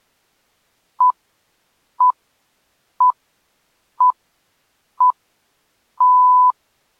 Radio time signal (six pips, as the Greenwich Time Signal), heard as pips.